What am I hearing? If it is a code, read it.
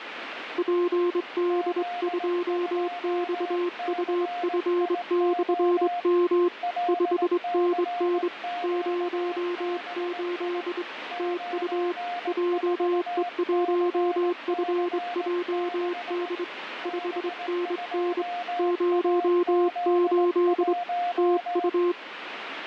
Morse code, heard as two keyed tones, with radio static. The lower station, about 24 wpm, 350 Hz: PD2XUF/M 5NN 08 TU JE1FJD 5NN 08 TU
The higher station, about 18 wpm, 710 Hz: Z2CIO LCQBI 94CC6 B2AZ1